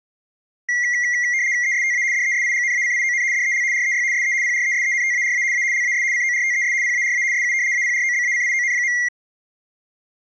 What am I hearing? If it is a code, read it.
RTTY (75 baud, 170 Hz shift), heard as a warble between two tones, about 2050 Hz centre. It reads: ESTA DESIGNACION DEL REY SE PRESENTARA A LAS CORTES PARA SU APROBACION.